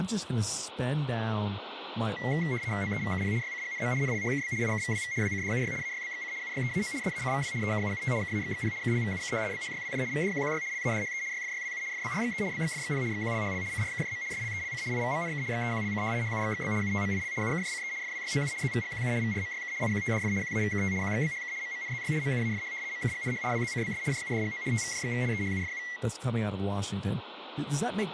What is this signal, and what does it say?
RTTY (75 baud, 170 Hz shift), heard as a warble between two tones, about 2050 Hz centre, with radio static and speech in English. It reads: OEVKP YCGNM NLHKB IKVWV WCDUY AYBXC UYEAO SACVW EKUUT KAXXP KLVUK BHYWJ VDQQY LADHE YFYWU FBRXE BXFXP XQLHL CRKJM SLELC IVMNK XEQLC HUXXB UTMIL UKJCE FWYOU ZVGQU VRMYK IQTDF QAVKT QXBHK MMNZY MUAFH MKGNH WZCBS JUDGO TVJXV EHUFU